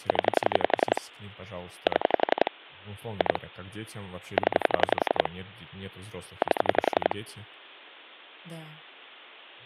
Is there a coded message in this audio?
Yes: pulse dialling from 0.1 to 7.1 s, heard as clicks on a phone line, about 11 pulses a second, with speech in Russian. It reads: 0 7 2 0 8